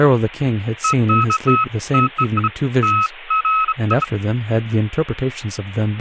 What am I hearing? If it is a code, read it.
Beeps of irregular length, with speech in English. There is no code.